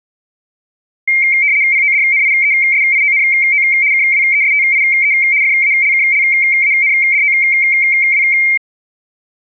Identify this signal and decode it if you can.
RTTY (75 baud, 170 Hz shift), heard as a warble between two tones, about 2200 Hz centre. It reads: PODNIESIONO KWESTIE FALKLANDOW